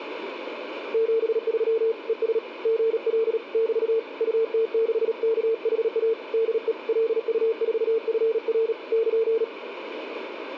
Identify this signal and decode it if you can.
Morse code, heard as a keyed tone, hand-sent with a paddle, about 37 wpm, 450 Hz, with radio static. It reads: 73 ES GL <BT> UT6KHA DE LU4FR <KN>